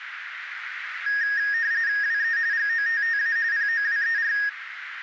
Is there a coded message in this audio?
Yes: RTTY (45.45 baud, 170 Hz shift) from 1.1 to 4.5 s, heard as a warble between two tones, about 1750 Hz centre, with radio static and a narrow filter. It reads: WE GOTTA POWER